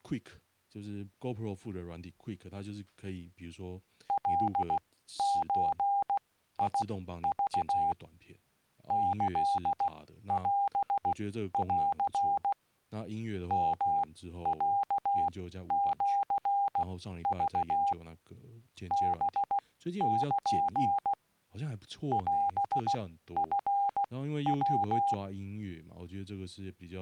Morse code (Japanese Wabun code), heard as a keyed tone, machine-sent, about 16 wpm, spaced as for 12 wpm, 800 Hz, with speech in Chinese. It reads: カゾク キオン ヨロシク ハル オチヤ